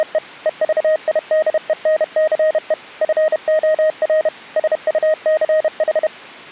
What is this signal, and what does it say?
Morse code, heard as a keyed tone, machine-sent, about 31 wpm, 620 Hz. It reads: … EVIDENCE FOR SUCH